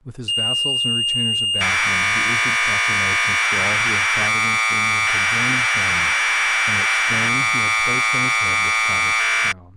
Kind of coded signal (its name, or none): Commodore tape loading